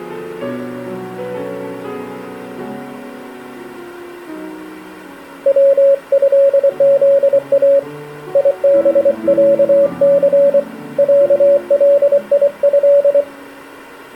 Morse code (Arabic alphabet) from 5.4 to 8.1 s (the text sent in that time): وهذا